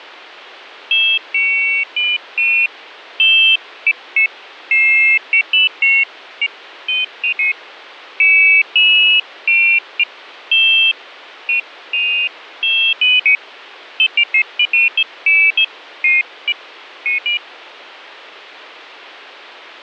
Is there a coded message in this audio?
No, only pairs of high tones at irregular times.